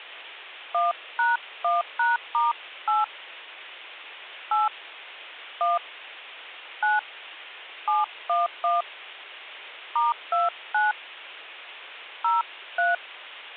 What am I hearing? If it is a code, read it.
DTMF, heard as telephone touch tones, dialled by hand, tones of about 170 ms. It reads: 1#1#*8 8 1 9 711 *29 03